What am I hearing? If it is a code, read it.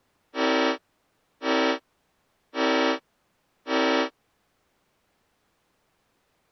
Train horn signal, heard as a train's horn. 4 short. On North American railways: a request for a signal to be given or repeated.